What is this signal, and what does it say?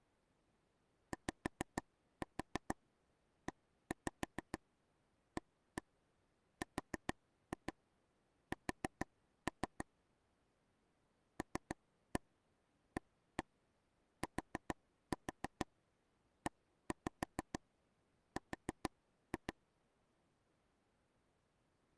Tap code, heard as taps on a table, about 6 knocks a second. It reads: YEARS LATER